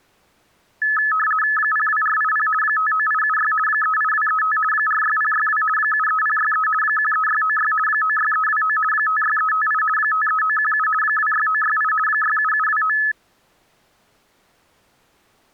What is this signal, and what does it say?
RTTY (50 baud, 450 Hz shift), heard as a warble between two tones, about 1500 Hz centre. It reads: 02480 59876 38235 46062 73063 13696 96329 56358 53917 26968 67729